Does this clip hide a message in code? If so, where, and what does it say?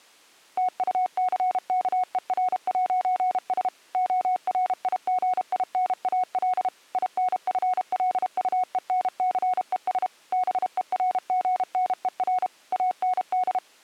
Yes: Morse code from 0.5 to 13.6 s, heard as a keyed tone, machine-sent, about 32 wpm, 740 Hz. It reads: TUCKER'S ORIGINAL INFLUENCES BERGNER AND